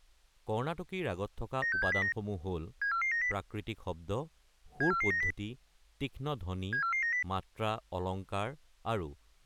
Five-tone selective call (CCIR), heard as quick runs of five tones, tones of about 100 ms, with speech in Assamese. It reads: 96709 74490 74490 74490